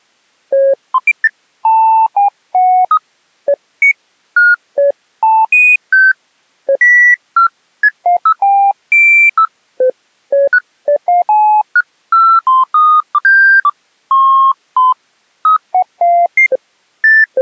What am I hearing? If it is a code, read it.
Electronic bleeps of random pitch and length. There is no code.